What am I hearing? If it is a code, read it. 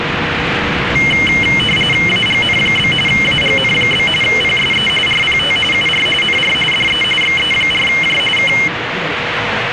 RTTY (45.45 baud, 850 Hz shift), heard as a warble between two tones, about 2550 Hz centre, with radio static and the noise inside a subway train. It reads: AGN? AGN? PSE RPT UR NR DE XE4J K